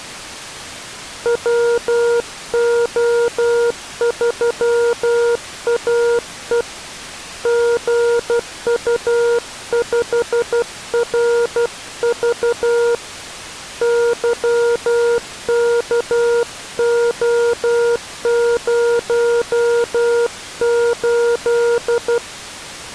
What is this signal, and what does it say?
Morse code, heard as a keyed tone, hand-sent with a paddle, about 12 wpm, 470 Hz. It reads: WO3AE GU5RV YKO08